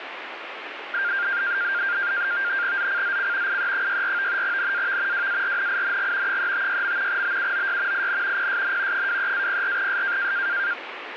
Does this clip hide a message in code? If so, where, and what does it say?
Yes: NAVTEX (SITOR-B), 100 baud, 170 Hz shift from 0.9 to 10.7 s, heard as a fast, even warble, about 1500 Hz centre, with radio static. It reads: ZCZC IE64 NAV WARNING 356. BUOY IN PSN 23-04S